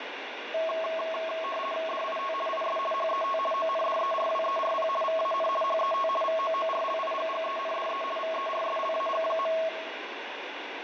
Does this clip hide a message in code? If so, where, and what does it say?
Yes: RTTY (50 baud, 450 Hz shift) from 0.5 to 9.7 s, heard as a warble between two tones, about 870 Hz centre, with radio static and room echo. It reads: DIT IS HET ONDERWERP VAN HET VOORLIGGENDE VERSLAG.